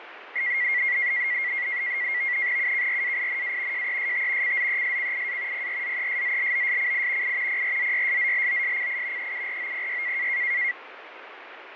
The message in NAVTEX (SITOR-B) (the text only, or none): UKRAINA JEST CZESCIA PRZESZLOSCI I PRZYSZLOSCI EUROPY